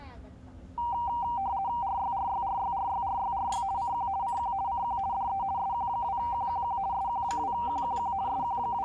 RTTY (50 baud, 170 Hz shift), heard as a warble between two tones, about 870 Hz centre, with the noise of a restaurant. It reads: RYRYRYRYRYRY CQ CQ CQ DE SQ2QQQ SQ2QQQ …